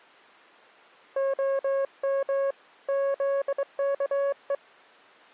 Morse code (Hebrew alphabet), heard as a keyed tone, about 23 wpm, 550 Hz. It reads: הם זכו